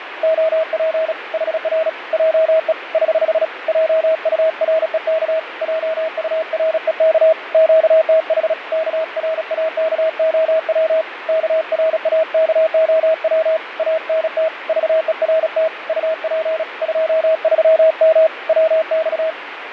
Morse code, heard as a keyed tone, hand-sent with a paddle, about 36 wpm, 640 Hz, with radio static and fading. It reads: OP HR JE <HH> JUREK JUREK QTH KRAKOW KRAKOW ANT VERT UP 23M WX